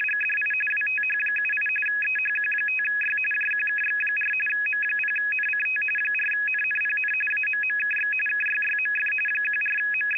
RTTY (45.45 baud, 850 Hz shift), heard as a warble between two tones, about 2100 Hz centre. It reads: … WTH78 EHQ5Y JQKX4 M0NCT 4NNPN AMMKX KYYMF …